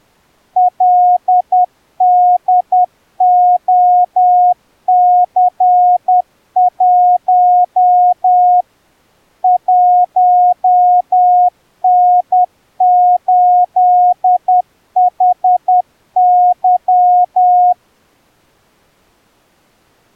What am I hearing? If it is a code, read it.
Morse code, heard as a keyed tone, machine-sent, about 10 wpm, 720 Hz. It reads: LDOC1 1N8HY